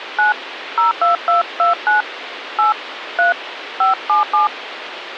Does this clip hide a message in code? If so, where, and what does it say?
Yes: DTMF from 0.2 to 4.5 s, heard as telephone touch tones, dialled by hand, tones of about 140 ms, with phone line noise. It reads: 9 02229 8 3 577